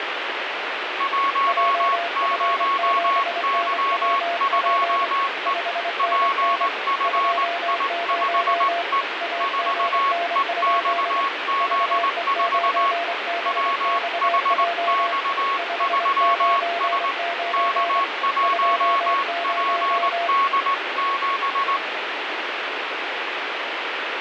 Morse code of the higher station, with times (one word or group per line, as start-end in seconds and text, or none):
1.0-5.5 10Y2E
6.0-9.0 PFI5E
9.4-12.9 4EXZ4
13.5-17.1 WHX3S
17.5-21.8 K1PD7